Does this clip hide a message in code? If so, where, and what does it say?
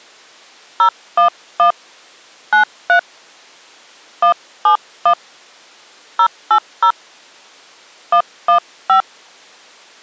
Yes: DTMF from 0.8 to 9.0 s, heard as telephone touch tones, dialled by hand, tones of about 90 ms. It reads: 011 93 171 080 115